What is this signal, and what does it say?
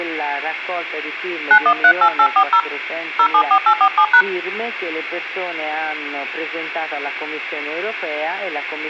DTMF, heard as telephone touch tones, dialled by hand, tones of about 80 ms. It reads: 9138840 074847#